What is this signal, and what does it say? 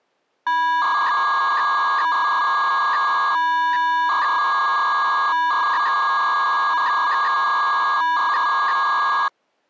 300-baud modem data (V.21 tones), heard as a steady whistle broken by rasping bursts, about 300 baud, 200 Hz shift.